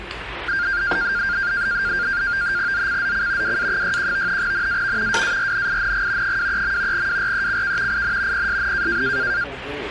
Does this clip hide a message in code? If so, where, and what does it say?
Yes: NAVTEX (SITOR-B), 100 baud, 170 Hz shift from 0.5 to 9.4 s, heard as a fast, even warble, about 1500 Hz centre, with radio static and the noise of a restaurant. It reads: ZCZC WA61 NAV WARNING 23. WRECK IN PSN